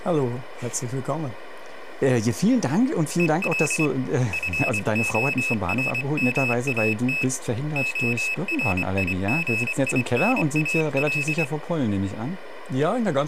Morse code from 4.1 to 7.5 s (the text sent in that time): FORMAT